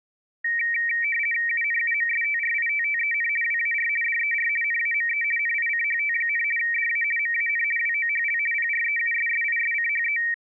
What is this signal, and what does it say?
RTTY (50 baud, 450 Hz shift), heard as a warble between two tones, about 2100 Hz centre. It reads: UNUMSTRITTEN WAR DER NAME NICHT, DA MAN WOHL PREUSSISCHE